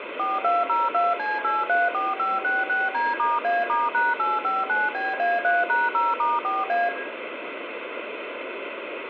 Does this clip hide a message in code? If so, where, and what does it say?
Yes: DTMF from 0.2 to 6.9 s, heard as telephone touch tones, dialled by machine, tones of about 190 ms, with phone line noise and room echo. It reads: 4202C834566D*A*#859BA3#0*4A